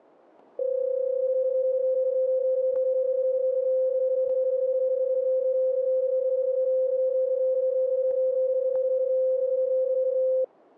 PSK31 (31.25 baud), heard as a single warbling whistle, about 520 Hz, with static crashes.